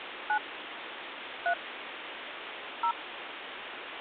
DTMF, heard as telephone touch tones, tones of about 80 ms, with phone line noise. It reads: 9 3 0